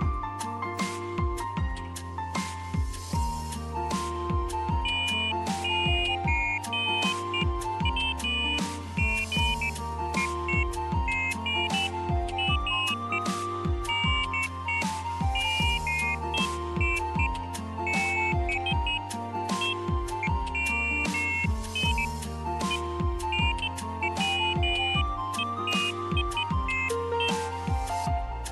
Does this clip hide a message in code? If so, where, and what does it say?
No, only pairs of high tones at irregular times.